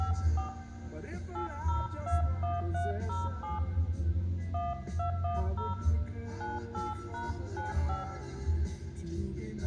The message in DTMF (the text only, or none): 54 8021307 1210 98#95